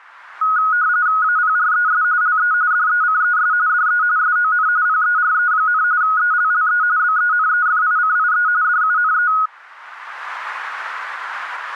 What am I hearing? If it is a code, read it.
RTTY (45.45 baud, 170 Hz shift), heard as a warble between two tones, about 1360 Hz centre. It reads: APRES LE DECES DE SON PERE, ELLE BENEFICIE DUNE